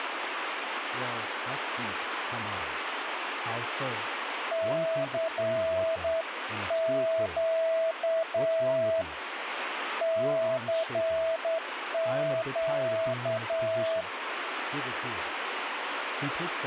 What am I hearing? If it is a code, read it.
Morse code, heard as a keyed tone, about 9 wpm, 650 Hz, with radio static and speech in English. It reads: CQ CQ